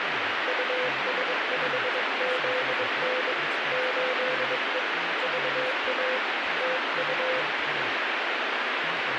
Morse code, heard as a keyed tone, hand-sent with a bug key, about 22 wpm, 510 Hz, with heavy radio static and speech in English. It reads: US5ZN 8E VA TU